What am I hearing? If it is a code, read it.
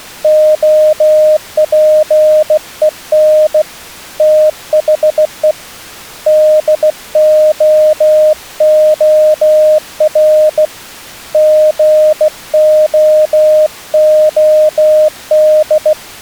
Morse code, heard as a keyed tone, hand-sent with a bug key, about 16 wpm, 620 Hz. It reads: OPEN THE DOOR GOOD